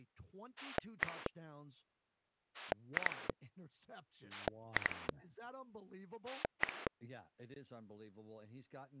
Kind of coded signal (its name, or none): pulse dialling